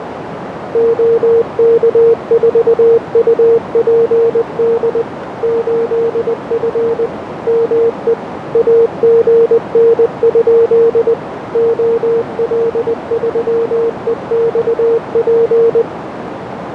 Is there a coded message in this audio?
Yes: Morse code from 0.7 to 15.9 s, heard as a keyed tone, machine-sent, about 20 wpm, 460 Hz, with radio static and a narrow filter. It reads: OK4UPD 8F ME AGN? OL3EXP